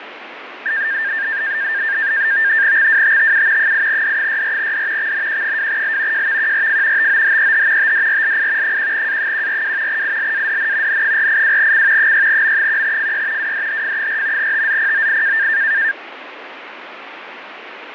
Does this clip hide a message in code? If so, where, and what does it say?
Yes: NAVTEX (SITOR-B), 100 baud, 170 Hz shift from 0.7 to 15.9 s, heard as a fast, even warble, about 1700 Hz centre, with radio static. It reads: XWTTU 8D64D XNQ2L JVQRF TOHEH TDRLI 1A142 ILADN N482C 6M1FY WDHF4 TZPOI